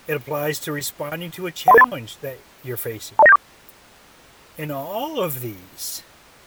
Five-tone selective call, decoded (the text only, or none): 13383 20974